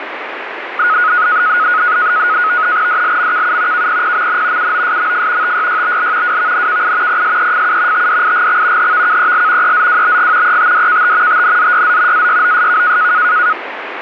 NAVTEX (SITOR-B), 100 baud, 170 Hz shift, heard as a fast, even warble, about 1360 Hz centre, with radio static. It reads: DLMKU KPPMN UOSMF TYYBL WVNKI PSEFU TDIGX HVKEL EZWBG ETDKT TNZYZ AYOSK